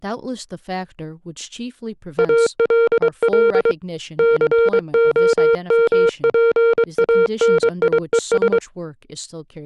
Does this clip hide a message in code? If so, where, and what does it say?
Yes: Morse code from 2.1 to 8.6 s, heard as a keyed tone, hand-sent with a paddle, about 23 wpm, 460 Hz, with speech in English. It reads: ALL COMPANIES